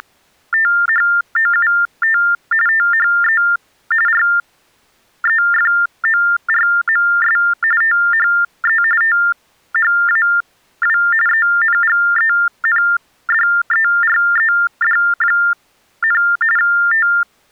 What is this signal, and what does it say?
TTY/TDD text telephone tones (45.45 baud Baudot), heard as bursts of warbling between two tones, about 400 Hz shift, 1600 Hz centre. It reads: … THE REFORMS THE THAW ENGENDERED, …